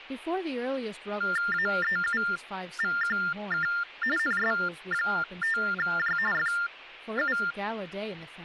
TTY/TDD text telephone tones (45.45 baud Baudot), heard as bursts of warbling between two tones, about 400 Hz shift, 1600 Hz centre, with speech in English. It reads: AEUVQK NS5J FU